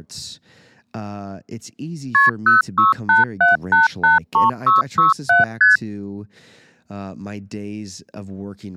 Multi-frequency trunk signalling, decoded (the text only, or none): KP 0687883667 ST